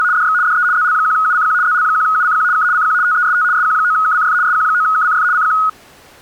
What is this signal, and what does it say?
RTTY (75 baud, 170 Hz shift), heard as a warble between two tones, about 1360 Hz centre. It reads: … DX DE ZL1UCQ ZL1UCQ K CQ TEST SQ9KCF SQ9KCF CQ